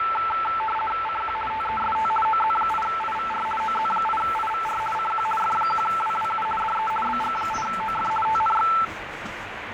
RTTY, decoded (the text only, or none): CQ TEST OZ8IVR OZ8IVR CQ F1WWU DE BG8OF TNX